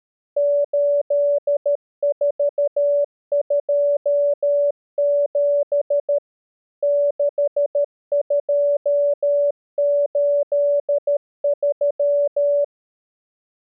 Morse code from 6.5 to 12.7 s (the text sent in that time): 6283